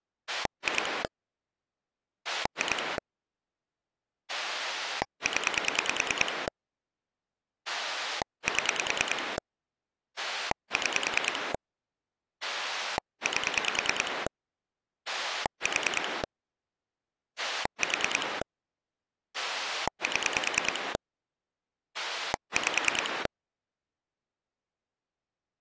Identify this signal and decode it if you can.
Pulse dialling, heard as a rotary dial, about 9 pulses a second. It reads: 2 2 0 7 6 8 4 4 7 5